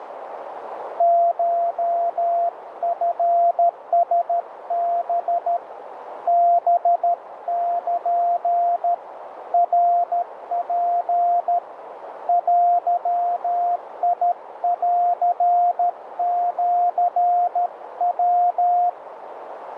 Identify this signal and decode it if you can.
Morse code (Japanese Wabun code), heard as a keyed tone, hand-sent with a paddle, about 13 wpm, 700 Hz, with radio static and a narrow filter. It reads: コチラハ ハル ナツ デンシヤ